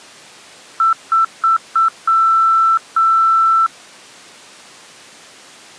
Beep code, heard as beeps, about 1330 Hz. 4 short, 2 long.